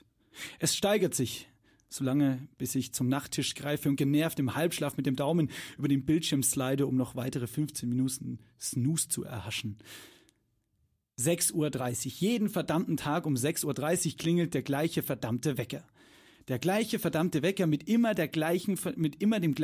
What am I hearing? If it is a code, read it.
Speech in German. There is no code.